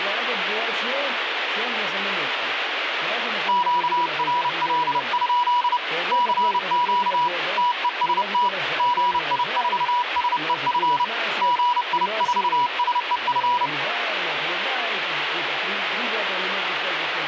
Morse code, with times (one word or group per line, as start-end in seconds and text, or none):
3.5-5.8 QRL?
6.1-7.3 CQ
7.6-8.5 TEST
8.8-11.0 GI4SEF
11.4-13.7 GI4SEF